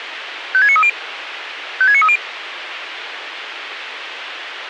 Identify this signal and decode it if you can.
Five-tone selective call (ZVEI), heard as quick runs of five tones, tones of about 70 ms, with radio hiss. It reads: 56930 56930